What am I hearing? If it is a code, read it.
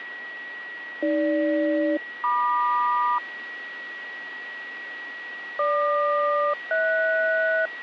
Aircraft SELCAL, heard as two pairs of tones, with radio static and a steady whistle near 1920 Hz. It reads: AG-MQ GQ-HS